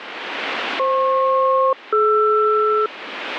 Aircraft SELCAL, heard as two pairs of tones, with radio static. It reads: FP-DR